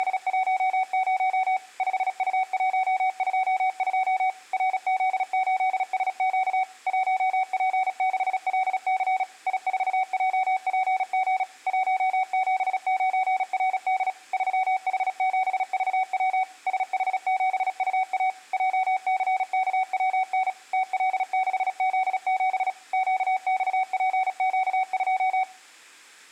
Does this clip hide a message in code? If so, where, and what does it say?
Yes: Morse code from 0.0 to 25.5 s, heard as a keyed tone, machine-sent, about 36 wpm, 750 Hz, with room echo. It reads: … 5U122 RZ8SQ 1P6LC I4JPG 179RD 3H7VW SH7UA JCKWN TL6Z7 QXPQ2